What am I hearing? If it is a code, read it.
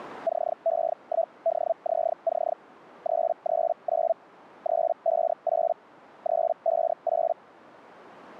Hellschreiber (Feld-Hell, 122.5 baud), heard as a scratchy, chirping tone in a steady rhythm, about 660 Hz. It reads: CE1DZC 339 358 358